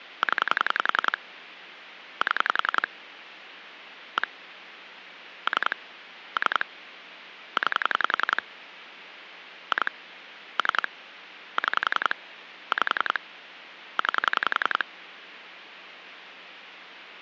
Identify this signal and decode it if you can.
Pulse dialling, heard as clicks on a phone line, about 11 pulses a second, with phone line noise. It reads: 0 7 1 3 3 9 2 3 6 5 9